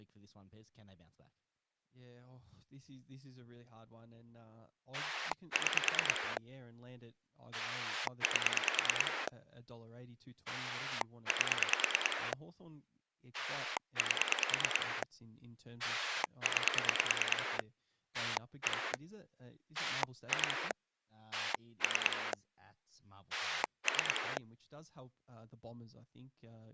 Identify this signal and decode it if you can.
Pulse dialling, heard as a rotary dial, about 9 pulses a second, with speech in English. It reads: 6 8 8 8 9 1 2 3 3